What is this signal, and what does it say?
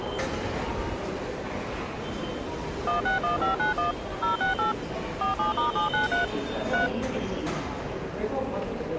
DTMF, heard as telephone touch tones, dialled by machine, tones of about 130 ms, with hum and the noise of a subway station. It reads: 161591 068 47*793 3